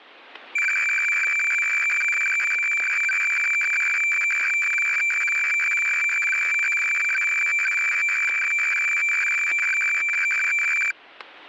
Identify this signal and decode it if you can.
Weather fax (radiofax), 120 lines a minute, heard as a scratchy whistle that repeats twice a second, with static crashes.